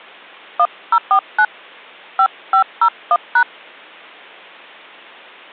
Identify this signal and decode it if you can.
DTMF, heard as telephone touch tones, dialled by hand, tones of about 80 ms. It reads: 1049 5501#